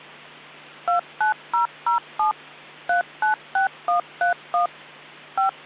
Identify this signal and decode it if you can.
DTMF, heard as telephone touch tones, dialled by machine, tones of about 120 ms, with hum. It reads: 29007 396131 5